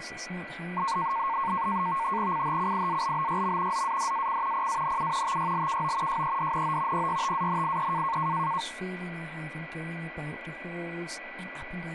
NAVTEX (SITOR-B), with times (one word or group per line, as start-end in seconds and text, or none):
2.3-3.8 CHCIALBYM
3.7-4.7 ZADAC
4.5-5.4 PANU
5.2-6.2 TYLKO
6.1-7.1 JEDNO
6.9-8.2 PYTANIE